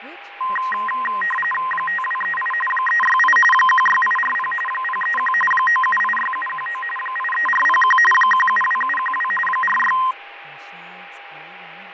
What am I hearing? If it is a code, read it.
RTTY (45.45 baud, 850 Hz shift), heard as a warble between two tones, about 1460 Hz centre, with radio static, fading, a steady whistle near 810 Hz and speech in English. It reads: 5238 368 16840 031 9786719 83401 172712 46